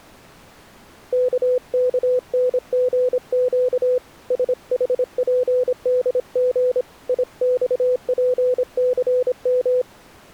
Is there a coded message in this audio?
Yes: Morse code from 1.1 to 9.9 s, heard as a keyed tone, hand-sent with a paddle, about 26 wpm, 500 Hz. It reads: KKNGQ SHPDG IXPCM